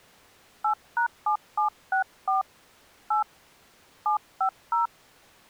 DTMF, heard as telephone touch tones, dialled by hand, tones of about 110 ms. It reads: 8#7764 8 750